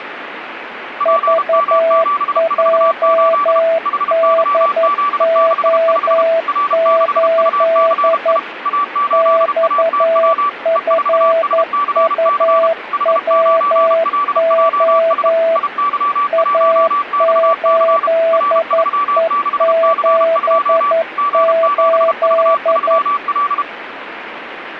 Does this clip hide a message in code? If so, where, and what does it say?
Yes: Morse code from 0.9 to 23.7 s, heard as two keyed tones, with radio static. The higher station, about 32 wpm, 1160 Hz: PM748 HYZ65 R6UCI A8ATW E4SCC H9LJS IY1XC R36C2 G7V3L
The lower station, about 11 wpm, 660 Hz: VJDO8 XFUWO A8E78